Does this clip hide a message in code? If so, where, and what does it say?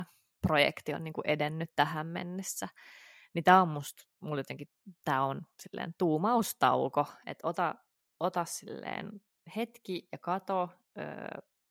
No, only speech in Finnish.